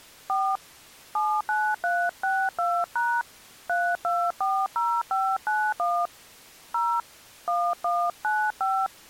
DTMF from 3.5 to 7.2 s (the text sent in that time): 3240591 0